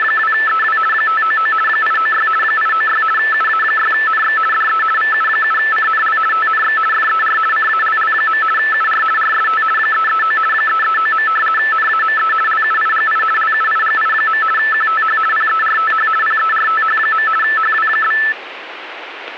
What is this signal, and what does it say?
RTTY (50 baud, 450 Hz shift), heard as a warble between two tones, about 1550 Hz centre, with radio static. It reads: … 599 896 896 UA6NX DE VU7CNL TNX FER CALL. UR RST 339 339. NAME LUIGI LUIGI. QTH PERTH PERTH. HW?